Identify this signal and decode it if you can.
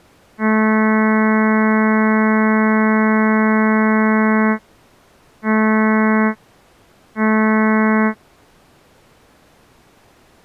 Ship horn signal, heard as a ship's horn, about 220 Hz. 1 long, 2 short. At sea: a vessel in fog that is sailing, fishing, towing or hampered.